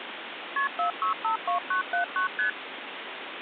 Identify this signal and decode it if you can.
Multi-frequency trunk signalling (R1, as on North American trunks), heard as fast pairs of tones, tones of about 110 ms, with phone line noise. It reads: KP 4652979 ST